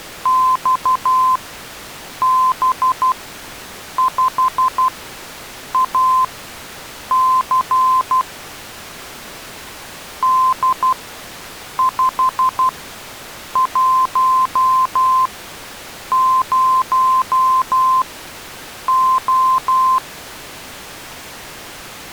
Morse code, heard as a keyed tone, machine-sent, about 12 wpm, spaced as for 7 wpm, 1040 Hz. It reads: XB5AC D510O